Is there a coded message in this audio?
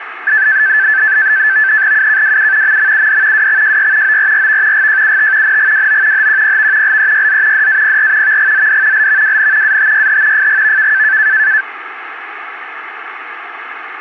Yes: NAVTEX (SITOR-B), 100 baud, 170 Hz shift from 0.3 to 11.6 s, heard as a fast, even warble, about 1650 Hz centre, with radio static. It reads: UKWU MMUD WXJY ORRV GJUT NGWO HQPV LEYZ DAPR VGZD LVWN ATYH FGVK